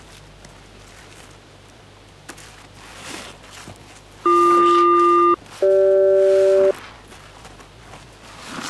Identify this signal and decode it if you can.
Aircraft SELCAL, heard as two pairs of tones. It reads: BQ-CG